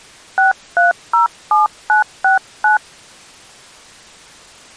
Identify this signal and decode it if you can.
DTMF, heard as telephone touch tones, dialled by hand, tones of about 130 ms. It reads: 6307969